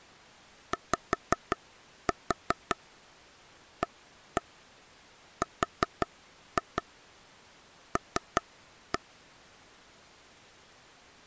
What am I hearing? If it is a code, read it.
Tap code, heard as taps on a table, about 5 knocks a second. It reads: YARL